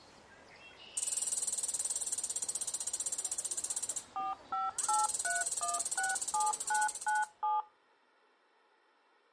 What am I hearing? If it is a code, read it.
DTMF, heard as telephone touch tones, dialled by machine, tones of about 170 ms. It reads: 4583167997